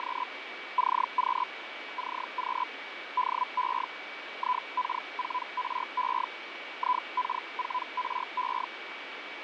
Hellschreiber (Feld-Hell, 122.5 baud), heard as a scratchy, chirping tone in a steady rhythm, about 1000 Hz, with radio static, fading and a steady whistle near 2280 Hz. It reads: … CQ CQ DE IK4RE IK4RE